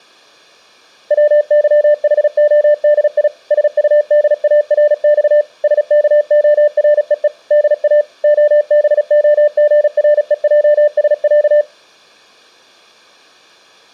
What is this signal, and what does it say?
Morse code (Russian alphabet), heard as a keyed tone, machine-sent, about 36 wpm, 590 Hz. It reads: ВЫХОДИ СУДАРЬ СКОРЕЕ ДА ОБОГРЕЙСЯ